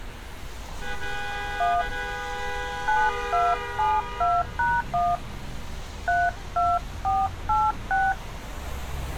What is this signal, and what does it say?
DTMF, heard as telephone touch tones, dialled by hand, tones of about 210 ms, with street noise. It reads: 1 9272#1 32486